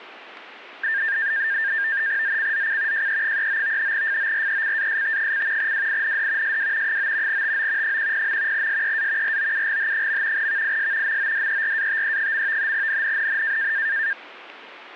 NAVTEX (SITOR-B), 100 baud, 170 Hz shift, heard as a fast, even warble, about 1700 Hz centre. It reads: ZCZC JE39 FORECAST: WIND SW 9 TO 10. SEA ROUGH. VIS MODERATE. NNNN